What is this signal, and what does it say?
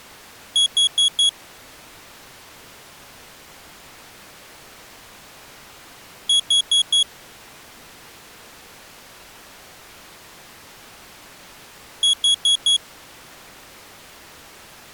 Alarm pattern, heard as an alarm's beeps, played three times, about 3350 Hz. Temporal four. Carbon monoxide.